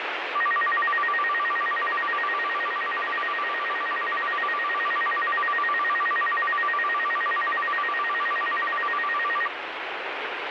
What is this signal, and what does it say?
A tone that alternates evenly between two pitches, with heavy radio static. There is no code.